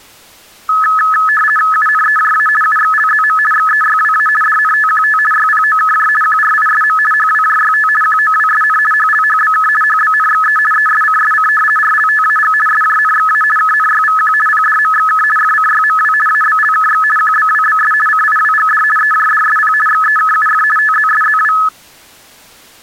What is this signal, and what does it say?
RTTY (50 baud, 450 Hz shift), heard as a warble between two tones, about 1500 Hz centre. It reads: UNEJA UXLZM XEYWA DNTQT YPOKJ QRISM HWJYT QOWSN HLHBK HBNXE ESCSC RLTAG SJNXA KNYVQ PDMXK FCYMW ABLKX QBWBS CIWGD EJDSP XEKUF TZSZW